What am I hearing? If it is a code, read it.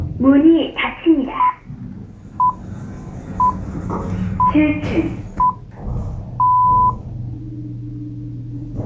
Radio time signal (six pips, as the Greenwich Time Signal), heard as pips, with the noise inside a lift.